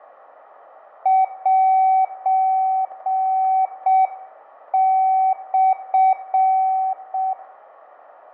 Morse code (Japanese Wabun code), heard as a keyed tone, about 6 wpm, 760 Hz, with radio static, fading and room echo. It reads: セモ